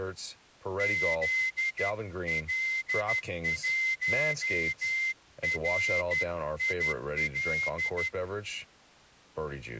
Morse code, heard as a whistle, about 12 wpm, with speech in English. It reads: ZL1RIL